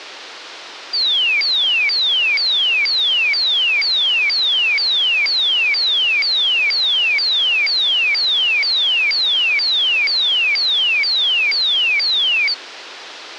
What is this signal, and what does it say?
A tone that sweeps in pitch again and again, with phone line noise. There is no code.